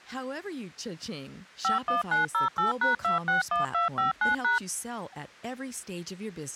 DTMF, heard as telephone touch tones, dialled by machine, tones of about 140 ms, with speech in English. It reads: 51908#261259#